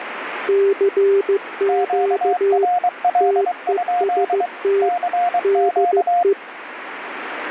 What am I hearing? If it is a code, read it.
Morse code, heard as two keyed tones, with radio static. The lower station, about 15 wpm, 400 Hz: CQ TEST DE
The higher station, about 23 wpm, 710 Hz: QRL? CQ